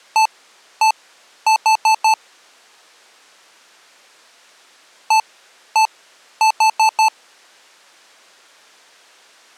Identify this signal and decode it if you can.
Beep code, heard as beeps from a small speaker, played twice, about 880 Hz. 1-1-4. In Phoenix BIOS tables: BIOS ROM checksum failure.